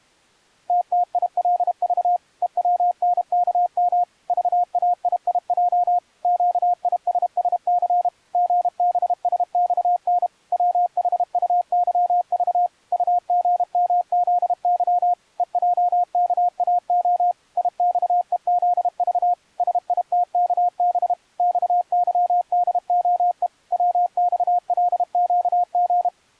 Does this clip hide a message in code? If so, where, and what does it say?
Yes: Morse code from 0.6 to 26.1 s, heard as a keyed tone, machine-sent, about 32 wpm, 710 Hz. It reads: TTILV EWNKM VAIIJ QISSC GBSXN WHUYV UGMZY EJKAO IXEZV SITKB XYDOE WXLQG